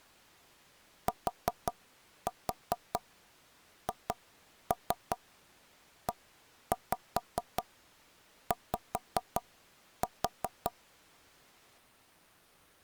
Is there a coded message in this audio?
Yes: tap code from 1.1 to 10.7 s, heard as knocks on wood, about 5 knocks a second. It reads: THEY